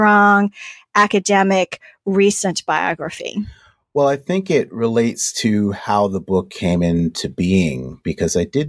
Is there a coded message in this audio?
No, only speech in English.